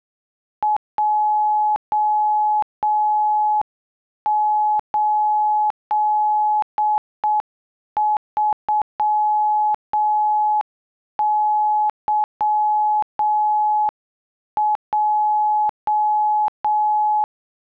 Morse code, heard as a keyed tone, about 7 wpm, 850 Hz. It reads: J83YJ